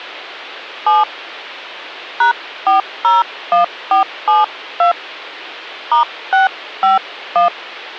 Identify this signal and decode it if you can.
DTMF, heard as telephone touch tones, dialled by hand, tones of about 140 ms. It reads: 7 #401472 *651